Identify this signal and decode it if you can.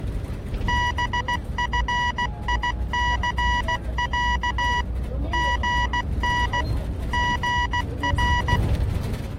Morse code (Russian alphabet), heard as electronic beeps, machine-sent, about 16 wpm, 970 Hz, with the noise inside a bus. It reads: БФИЦЯ ГН ГР